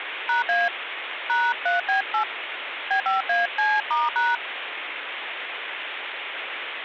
DTMF, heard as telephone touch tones, dialled by hand, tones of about 170 ms, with phone line noise. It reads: #A #3B8 B5AC*#